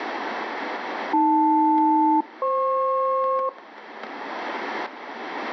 Aircraft SELCAL, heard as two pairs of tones, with static crashes. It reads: AL-FP